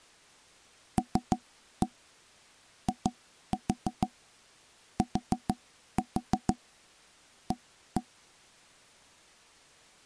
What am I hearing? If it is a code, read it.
Tap code, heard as knocks on wood, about 6 knocks a second. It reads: LITA